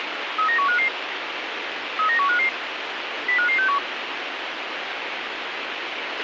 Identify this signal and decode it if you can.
Five-tone selective call (CCIR), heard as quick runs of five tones, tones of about 100 ms, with radio hiss and a squelch burst at the end. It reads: 39155 39155 05561